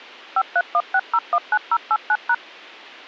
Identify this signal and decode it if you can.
DTMF, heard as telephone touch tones, dialled by machine, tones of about 60 ms. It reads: 5316019089#